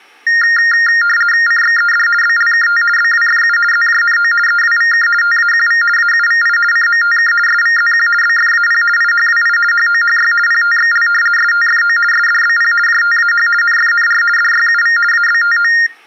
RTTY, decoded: CXED BLKT BWFU ZJNO EWVK TAQV AUVI CMTK SVZQ BFAP IHWI HOHY PTXL STFO SDBP JTAH NFNR DYUV ABTO

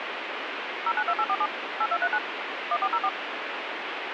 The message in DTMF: 092847 8239 1404

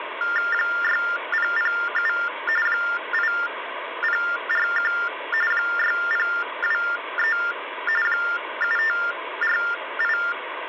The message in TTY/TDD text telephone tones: 6007 8041 6023 7548

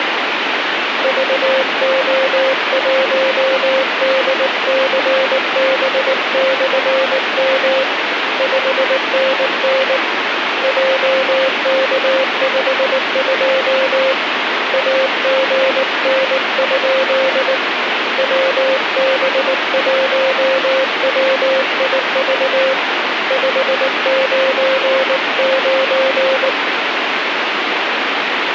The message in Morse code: VO1DCB/M 5NN JK52 AGN? WB1WIV 599

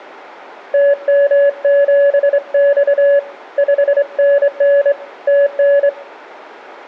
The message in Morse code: TM7X 5NN TN

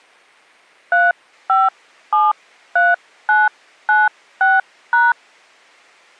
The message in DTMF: 3573996#

